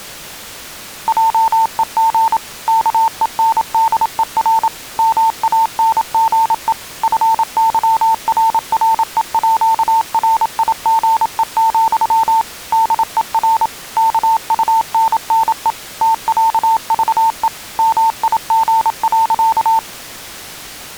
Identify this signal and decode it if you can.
Morse code (with Danish letters), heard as a keyed tone, machine-sent, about 27 wpm, 900 Hz. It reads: JEG KENDER MANGE FYRREÅRIGE, DER KUNNE TÆVE MIG.